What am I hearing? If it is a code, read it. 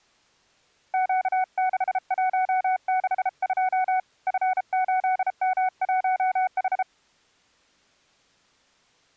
Morse code, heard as a keyed tone, hand-sent with a paddle, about 33 wpm, 750 Hz. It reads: Q6162 F8M1H